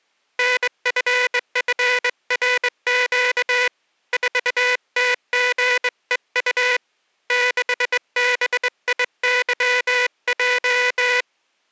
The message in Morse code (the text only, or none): NFFRQ 4TGEU 6BIYJ